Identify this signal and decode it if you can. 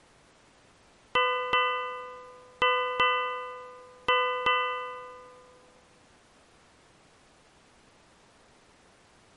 Ship's bell, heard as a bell. 6. Six half-hours of the watch have passed.